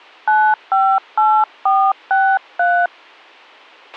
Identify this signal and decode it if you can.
DTMF, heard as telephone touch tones, dialled by hand, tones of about 260 ms, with a squelch burst at the end. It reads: 958463